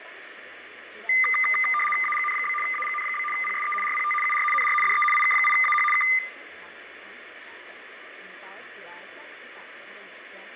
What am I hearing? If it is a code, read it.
RTTY (75 baud, 850 Hz shift), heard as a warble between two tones, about 1600 Hz centre, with radio static, fading and room echo. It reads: AGN? AGN? PSE RPT UR NR DE IK8AH K